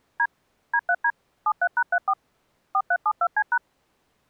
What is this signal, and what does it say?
DTMF, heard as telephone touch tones, dialled by machine, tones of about 60 ms. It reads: D D3D 73#34 4372C#